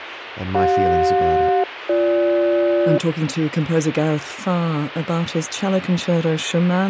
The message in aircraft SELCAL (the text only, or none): CJ-BG